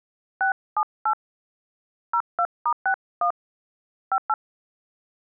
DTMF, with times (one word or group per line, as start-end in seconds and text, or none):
0.4-1.1 678
2.1-3.3 02*61
4.1-4.3 58